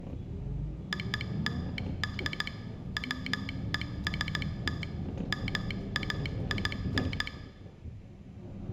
Morse code (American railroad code), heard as a telegraph sounder, machine-sent, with room echo and the noise inside a bus. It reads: OLD WEST MAIN